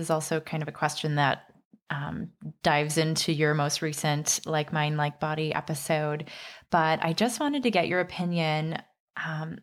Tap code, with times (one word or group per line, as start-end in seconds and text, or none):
none